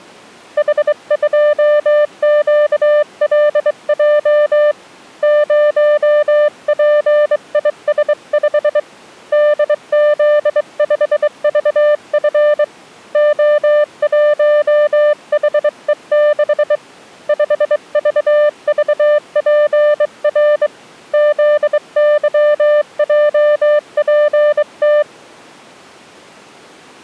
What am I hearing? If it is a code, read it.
Morse code, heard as a keyed tone, hand-sent with a straight key, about 23 wpm, 600 Hz. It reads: H2QLJ 0PIS5 DZ5VF O1HE6 5VVPR ZYJPT